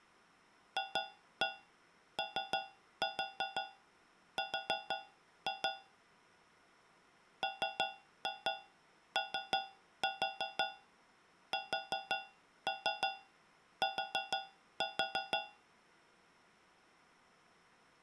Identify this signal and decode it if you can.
Tap code, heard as taps on a metal pipe, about 5 knocks a second. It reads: FOR MOST